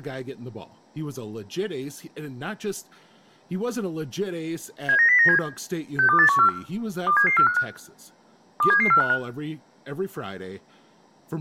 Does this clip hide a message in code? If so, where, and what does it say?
Yes: five-tone selective call (CCIR) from 4.9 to 9.1 s, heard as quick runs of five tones, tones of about 100 ms, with room echo and speech in English. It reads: 79097 62814 27745 27745